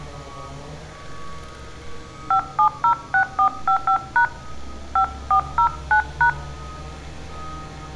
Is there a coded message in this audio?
Yes: DTMF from 2.3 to 6.3 s, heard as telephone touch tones, dialled by hand, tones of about 90 ms, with room echo and street noise. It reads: 5706455# 5409#